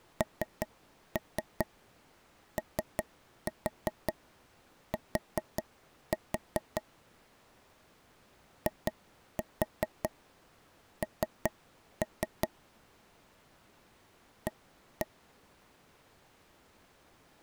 Tap code, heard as taps on a table, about 5 knocks a second. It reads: NOT IN A